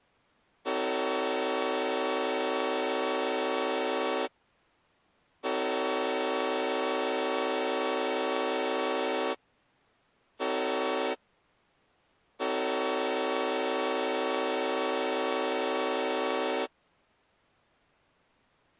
Train horn signal, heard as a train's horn. 2 long, 1 short, 1 long. On North American railways: approaching a public crossing.